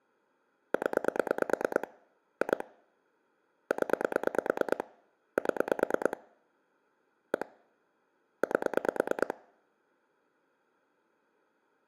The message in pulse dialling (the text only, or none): 0 2 0 7 1 8